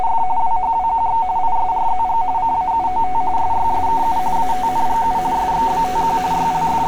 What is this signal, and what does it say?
RTTY (45.45 baud, 170 Hz shift), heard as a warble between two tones, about 830 Hz centre, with street noise. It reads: … WHWQX ISRZG CAUOT SYSKU ATNGU SXBTQ …